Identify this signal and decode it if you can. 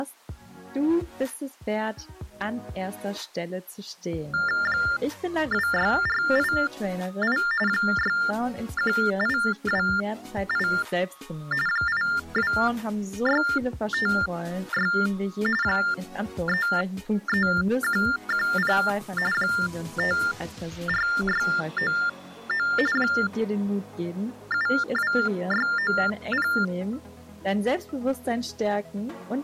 TTY/TDD text telephone tones (45.45 baud Baudot), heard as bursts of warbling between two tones, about 400 Hz shift, 1600 Hz centre. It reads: 26488 61828 82656 33110 54699 72690